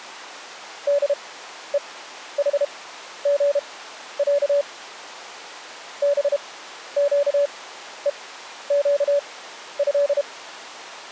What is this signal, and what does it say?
Morse code (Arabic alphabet), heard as a keyed tone, machine-sent, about 32 wpm, spaced as for 12 wpm, 570 Hz. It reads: دءحغع بقءقه